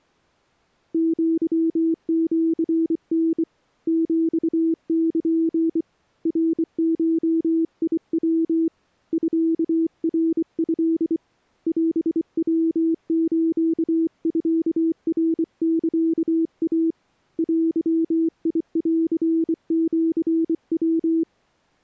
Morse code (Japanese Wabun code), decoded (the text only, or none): アシタ ヒル ナゴヤ ミナト オヤスミナサイ デンシヤ